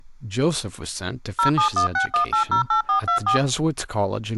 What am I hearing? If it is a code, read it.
DTMF, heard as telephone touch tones, dialled by machine, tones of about 110 ms, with speech in English. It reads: 07161808424